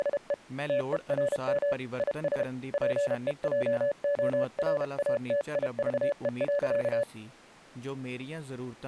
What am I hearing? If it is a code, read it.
Morse code, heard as a keyed tone, hand-sent with a paddle, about 32 wpm, 570 Hz, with speech in Punjabi. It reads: … TERM IS PEJORATIVE.